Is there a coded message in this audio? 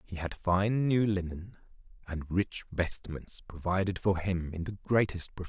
No, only speech in English.